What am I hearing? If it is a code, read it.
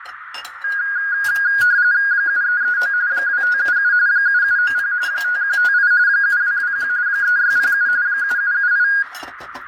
RTTY (45.45 baud, 170 Hz shift), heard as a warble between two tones, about 1550 Hz centre, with radio static, fading, a narrow filter and kitchen noise. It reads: 7339 2577 7790 5158 7221 3607 7778